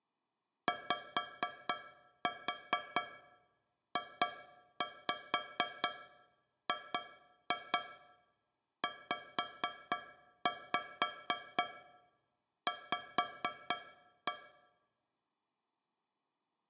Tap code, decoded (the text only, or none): YJGZV